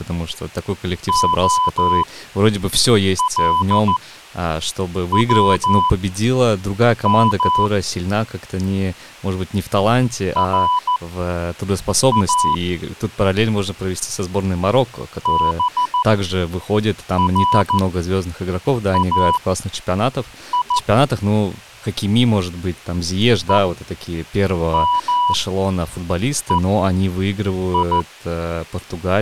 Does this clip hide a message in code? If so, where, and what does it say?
Yes: Morse code (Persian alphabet) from 1.0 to 28.1 s, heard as a keyed tone, machine-sent, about 14 wpm, spaced as for 6 wpm, 990 Hz, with speech in Russian. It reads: علوم را برای همهی